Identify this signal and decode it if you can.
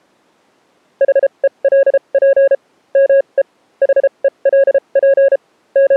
Morse code, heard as a keyed tone, machine-sent, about 33 wpm, spaced as for 27 wpm, 550 Hz. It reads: HELP ME HELP …